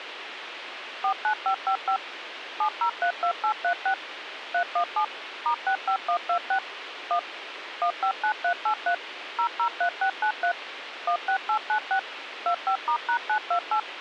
DTMF, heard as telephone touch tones, dialled by machine, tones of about 90 ms, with radio hiss. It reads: 49555 7032836 317 *65126 1 159383 003693 16896 25*#928